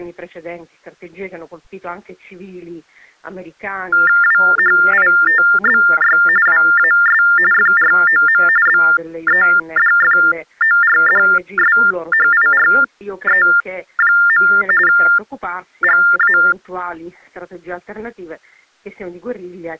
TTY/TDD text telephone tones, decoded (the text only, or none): WHITBY WAS FROM BEDFORDSHIRE. GA